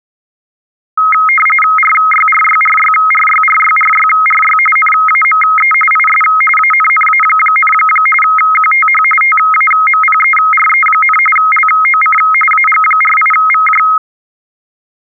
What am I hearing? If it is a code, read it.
RTTY (45.45 baud, 850 Hz shift), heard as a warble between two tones, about 1700 Hz centre. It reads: RYRYRYRYRYRYRY NAME IS ANNA, QTH TAMPERE, LOC AG48VJ